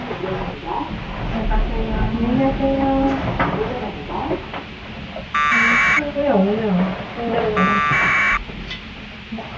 Packet radio (AX.25, as in APRS), 1200 baud, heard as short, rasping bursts, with the noise inside a lift.